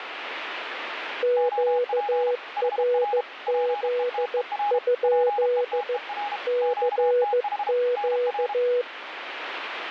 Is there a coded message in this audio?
Yes: Morse code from 1.2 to 8.9 s, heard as two keyed tones, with radio static. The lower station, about 15 wpm, 490 Hz: QRZ? CQ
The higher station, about 32 wpm, 820 Hz: OP HR PETER PETER QTH NR